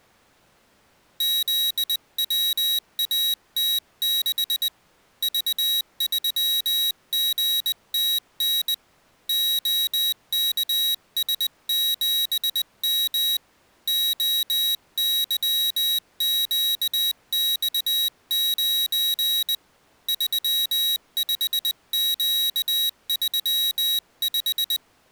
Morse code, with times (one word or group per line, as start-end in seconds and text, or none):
1.2-4.7 ZWAT6
5.2-8.7 V3GTN
9.3-13.4 OKS7M
13.9-19.5 OYQX9
20.1-24.8 35Q35